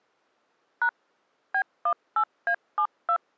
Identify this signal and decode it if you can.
DTMF, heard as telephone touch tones, dialled by machine, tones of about 80 ms. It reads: # B18A72